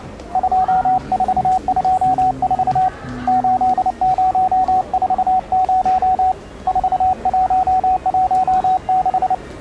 Morse code, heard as a keyed tone, hand-sent with a paddle, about 29 wpm, 750 Hz, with the noise of a subway station. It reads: 2424 8040 4116